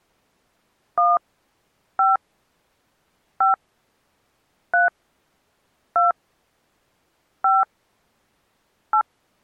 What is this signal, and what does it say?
DTMF, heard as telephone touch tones, dialled by hand, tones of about 140 ms. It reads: 1 5 5 3 2 5 8